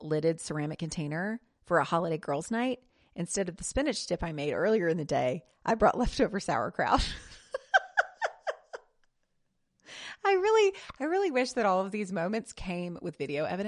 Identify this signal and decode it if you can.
Speech in English. There is no code.